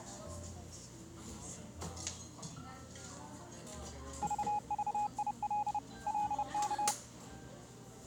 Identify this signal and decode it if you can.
Morse code, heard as a keyed tone, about 30 wpm, 830 Hz, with the noise of a cafe. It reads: VVIL LK